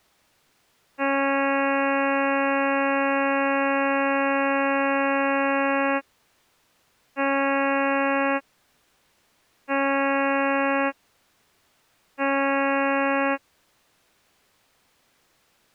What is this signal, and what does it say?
Ship horn signal, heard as a ship's horn, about 280 Hz. 1 long, 3 short. At sea: a vessel under tow in fog.